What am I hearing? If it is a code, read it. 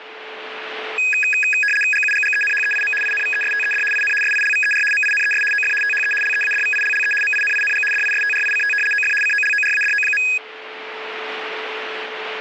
RTTY (75 baud, 850 Hz shift), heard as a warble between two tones, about 2100 Hz centre, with radio static and a steady whistle near 440 Hz. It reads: GUGGENHEIM INVESTED IN SILVER MINES OF THE LEADVILLE MINING DISTRICT OF COLORADO.